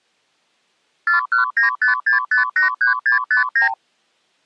Multi-frequency trunk signalling (R2, with the far end's replies), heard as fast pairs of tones, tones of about 120 ms. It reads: 41956583659